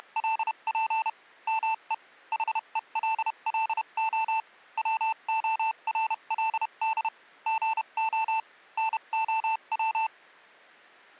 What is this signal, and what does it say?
Morse code, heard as electronic beeps, machine-sent, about 31 wpm, spaced as for 27 wpm, 890 Hz. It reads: … ME HELLO WORLD GO NOW